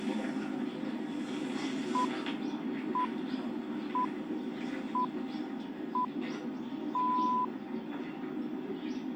Radio time signal (six pips, as the Greenwich Time Signal), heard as pips, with the noise of a park.